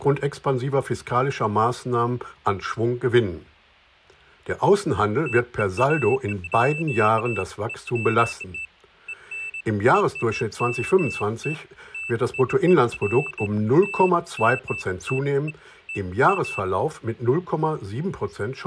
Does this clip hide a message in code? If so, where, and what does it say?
No, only beeps of irregular length.